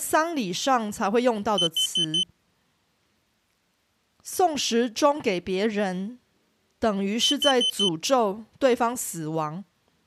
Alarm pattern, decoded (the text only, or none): temporal four